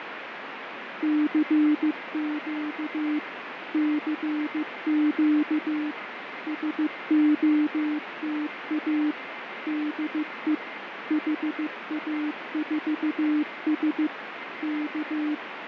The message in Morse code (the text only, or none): CQ CQ SOTA DE HA4S K